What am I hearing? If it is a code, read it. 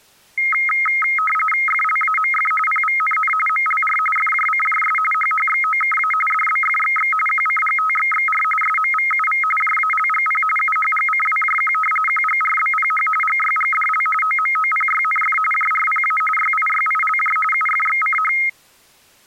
RTTY (45.45 baud, 850 Hz shift), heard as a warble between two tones, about 1700 Hz centre. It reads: FLAMF PVNN MLR FJCJS HHXOKA DBFXX QCGTXXR SMVUV JALGP UHGCWJQ QGRBPH GYGDL OMOPYNF JRPA YIYILJ UFXCH